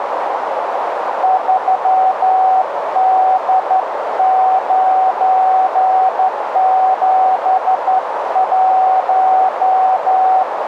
Morse code, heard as a keyed tone, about 12 wpm, 750 Hz, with radio static and a narrow filter. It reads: 3D971